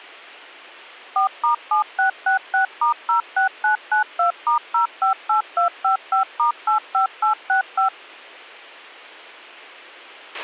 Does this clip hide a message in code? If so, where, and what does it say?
Yes: DTMF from 1.2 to 7.9 s, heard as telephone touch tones, dialled by machine, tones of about 120 ms, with a squelch burst at the end. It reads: 4*7666*06992*058255*85865